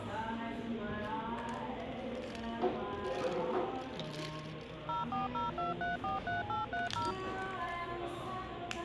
DTMF, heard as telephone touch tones, dialled by machine, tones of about 150 ms, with the noise of a cafe. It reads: 0402343830